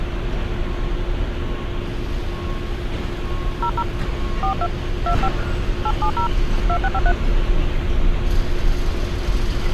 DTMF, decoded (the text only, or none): 00 42 25 870 2653